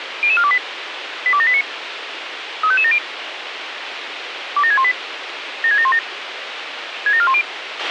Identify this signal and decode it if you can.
Five-tone selective call (ZVEI), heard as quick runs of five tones, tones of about 70 ms, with radio hiss and a squelch burst at the end. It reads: 00428 82789 35570 27618 76717 67410